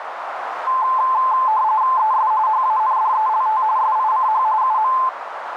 RTTY (45.45 baud, 170 Hz shift), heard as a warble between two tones, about 960 Hz centre, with radio static and a narrow filter. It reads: ES HANDELT SICH UM